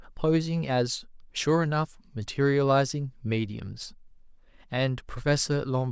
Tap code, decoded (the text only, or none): none